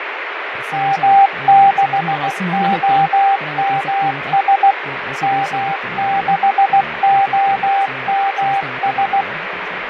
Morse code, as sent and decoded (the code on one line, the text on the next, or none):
-- -.... --- -- ... / -- -.... --- -- ...
M6OMS M6OMS